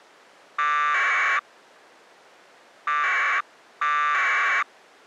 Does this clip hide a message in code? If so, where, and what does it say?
Yes: packet radio (AX.25, as in APRS), 1200 baud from 0.6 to 4.6 s, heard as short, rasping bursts.